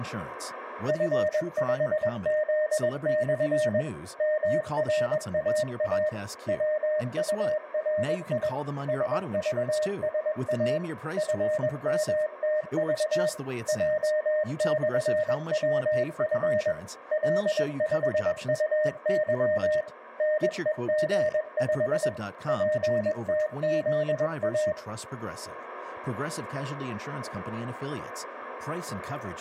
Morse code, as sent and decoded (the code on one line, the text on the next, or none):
..-. ..... --.. -..-. / -- .-. .- .- / .-- ..- .-. .. / ... ...- ... .- / ..-. -- - ...- / .--- -..-. .-- ..-. / .-.. ..... ..- -.-- / -. . --. ..... / .--. - --.. .-
F5Z/ MRAA WURI SVSA FMTV J/WF L5UY NEG5 PTZA